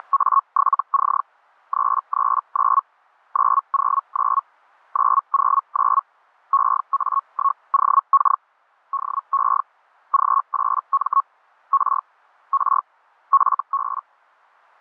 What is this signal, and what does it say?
Hellschreiber (Feld-Hell, 122.5 baud), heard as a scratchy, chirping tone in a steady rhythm, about 1100 Hz. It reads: … 339 909 909 EA1OK DE G8M R R FB